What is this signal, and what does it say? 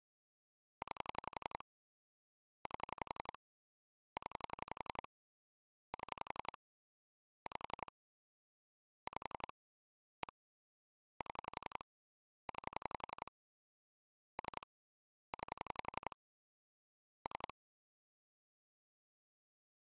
Pulse dialling, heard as clicks on a phone line, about 11 pulses a second. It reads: 9 8 0 7 5 5 1 7 9 3 9 3